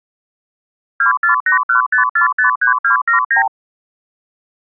Multi-frequency trunk signalling (R2, with the far end's replies), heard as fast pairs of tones, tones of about 120 ms. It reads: 24815453279